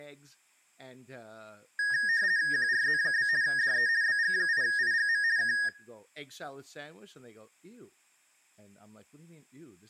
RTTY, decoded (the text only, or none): QRZ? DE BG8IGM K